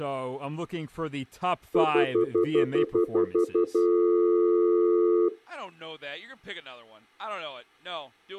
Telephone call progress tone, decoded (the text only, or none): stutter dial tone